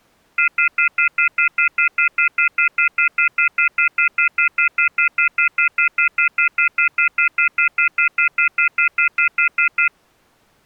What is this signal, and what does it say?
Telephone call progress tone (North American plan), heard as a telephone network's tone, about 1400, 2050, 2450, 2600 Hz, 0.1 s on and 0.1 s off. Off-hook warning tone.